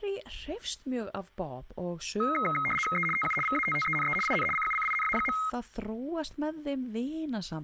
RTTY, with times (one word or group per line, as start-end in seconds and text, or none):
3.0-3.1 E
3.2-3.4 TU
3.5-4.2 VATTENE
4.3-4.5 IN
4.6-5.4 CUCINA.